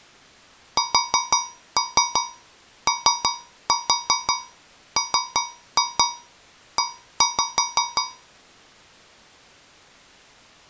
Tap code, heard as taps on a metal pipe, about 5 knocks a second. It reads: SOME